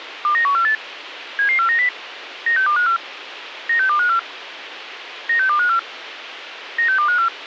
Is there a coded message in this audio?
Yes: five-tone selective call (CCIR) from 0.2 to 7.3 s, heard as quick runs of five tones, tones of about 100 ms, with radio hiss. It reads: 29148 77490 96254 96254 96254 96254